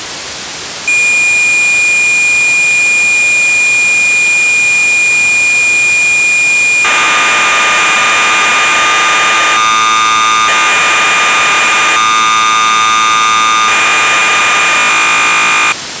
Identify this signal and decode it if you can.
Cassette data (Kansas City type), 1200 baud, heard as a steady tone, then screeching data, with tape hiss.